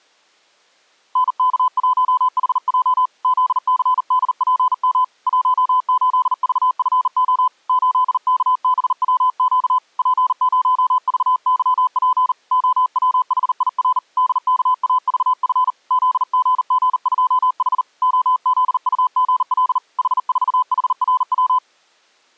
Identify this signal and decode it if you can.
Morse code, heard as a keyed tone, hand-sent with a bug key, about 39 wpm, 1010 Hz. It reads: NK1HJ ZCDPM 18VFO 8KBWQ P0VYP OWHIR DKAVF ZGG2H OZUGL H4HRW